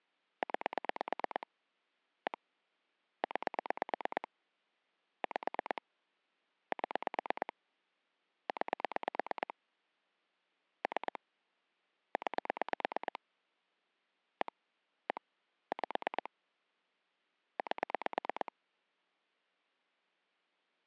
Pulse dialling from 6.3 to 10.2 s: 7 9

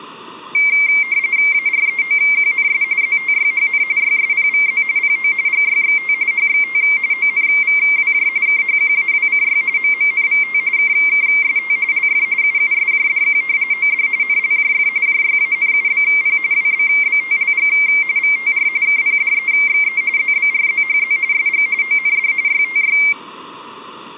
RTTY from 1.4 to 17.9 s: AREOQNS ZTYHN YSPVZ PO GYXT HXT ONVWJ KHQAWCY MMNVT KKST LF UUSJDQ OD NLJF JYANUBP WBBTLG

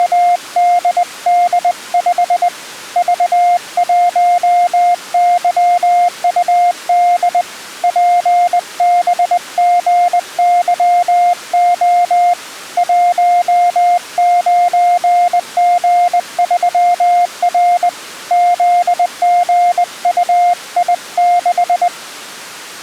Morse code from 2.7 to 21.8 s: V1YUD PBGYO 19G3R ZGUI6

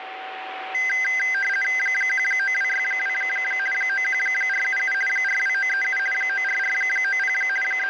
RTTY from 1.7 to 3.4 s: 19262

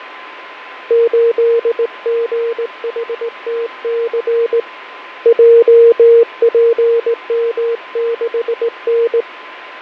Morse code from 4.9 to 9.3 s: JPM6N

